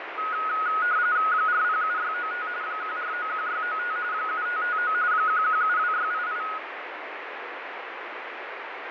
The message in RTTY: 407695 1491695 7559 1172688

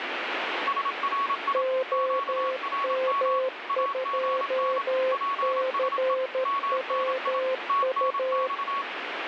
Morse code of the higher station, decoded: SRI QRM AGN PSE MNI TNX

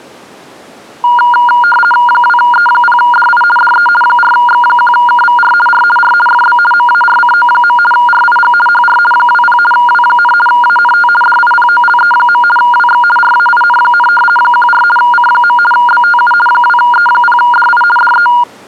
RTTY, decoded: 2E0DI DE 4X1KVR R R FB MARCO. RIG HR 20 W, ANT DIPOLE. WX RAIN, 14 C. BTU 2E0DI DE

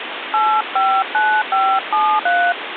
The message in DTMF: 859573

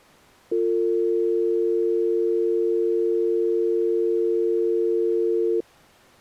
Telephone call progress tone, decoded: dial tone

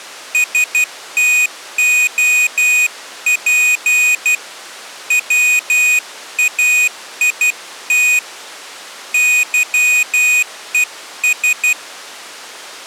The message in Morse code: STOP WAIT YES

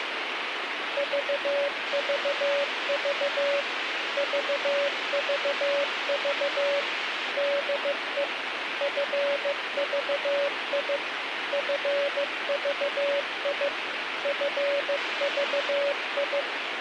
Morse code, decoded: VVV VVV DE FVI FVI FVI

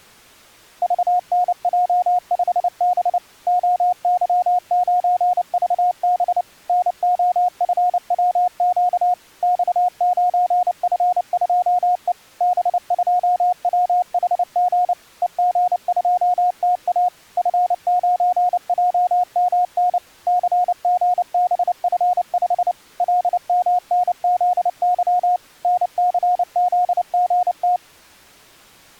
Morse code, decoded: VNJ5B OY9VB NOFWQ X9F2E B2WHG EG2TA F9JMN CGBF5 LMNZY NCZGT

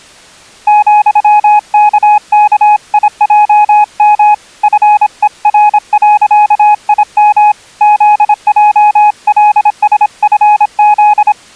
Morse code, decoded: ,KKIJM FER.IM ZJLSFZ

